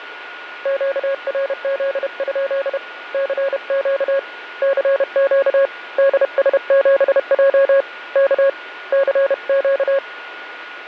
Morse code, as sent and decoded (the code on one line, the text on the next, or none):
--.- .-. --.. ..--.. / -.-. --.- / -.-. --.- / -.. ... --... .--- / -.- / -.-. --.-
QRZ? CQ CQ DS7J K CQ